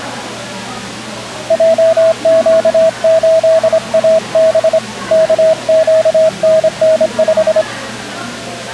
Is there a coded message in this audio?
Yes: Morse code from 1.4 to 7.7 s, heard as a keyed tone, hand-sent with a straight key, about 25 wpm, 640 Hz, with the noise of a crowd indoors. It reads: JQ8AB KQNN5